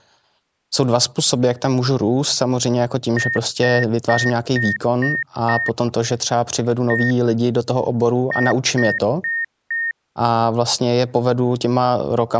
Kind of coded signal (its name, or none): beep code